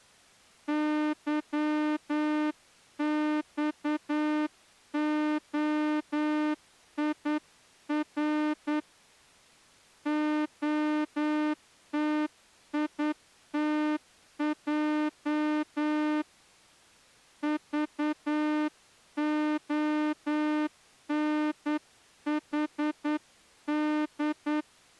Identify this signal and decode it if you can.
Morse code, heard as a horn, hand-sent with a straight key, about 9 wpm. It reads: YXOIR OTITJ VONHD